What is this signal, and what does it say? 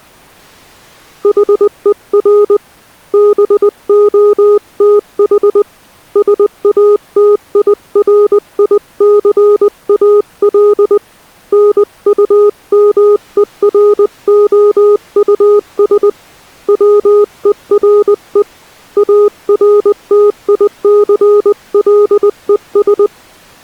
Morse code, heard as a keyed tone, hand-sent with a paddle, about 20 wpm, 410 Hz. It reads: HER BOTH SATIRICAL NUMEROUS WERE ARTICLES